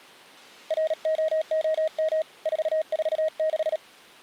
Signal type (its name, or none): Morse code